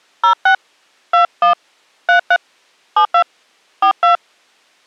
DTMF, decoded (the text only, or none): 06 21 33 72 42